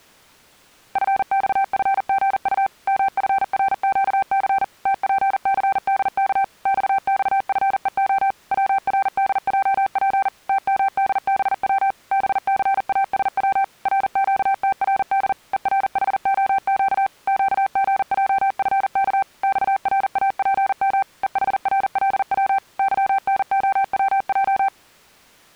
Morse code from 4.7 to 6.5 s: TPCDK

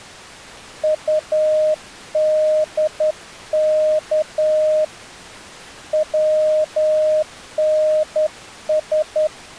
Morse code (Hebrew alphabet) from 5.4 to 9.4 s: צנש

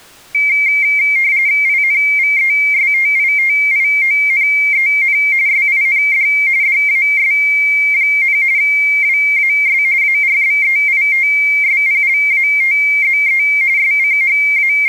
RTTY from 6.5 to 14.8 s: DAS, WAS ARBEITSPLATZE …

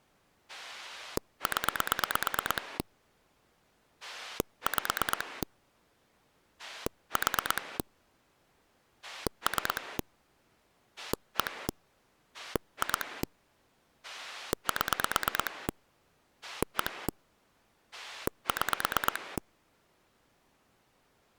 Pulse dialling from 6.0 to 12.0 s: 4 3 1

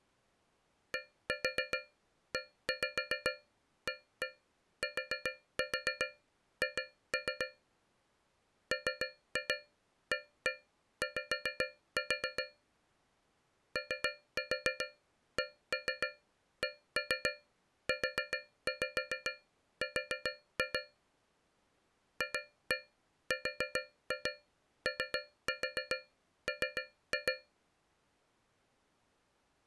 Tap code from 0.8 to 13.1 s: DEATH MAY

